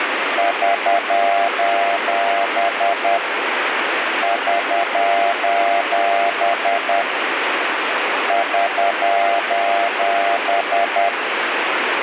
Morse code, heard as a keyed tone, hand-sent with a paddle, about 10 wpm, 690 Hz, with radio static. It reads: <SOS> <SOS> <SOS>